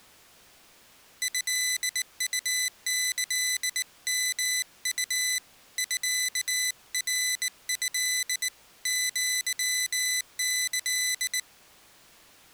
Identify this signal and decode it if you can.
Morse code (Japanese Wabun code), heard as a high beeper, hand-sent with a bug key, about 19 wpm, 2000 Hz. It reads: トウキヨウ ミナト アキ